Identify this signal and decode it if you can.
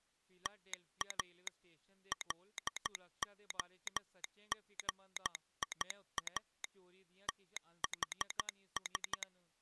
Morse code (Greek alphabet), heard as a telegraph sounder, machine-sent, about 13 wpm, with speech in Dogri. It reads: ΤΑ ΛΟΓΙΑ ΤΗΣ